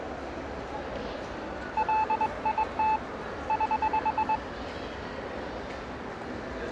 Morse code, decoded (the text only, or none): LIT <HH>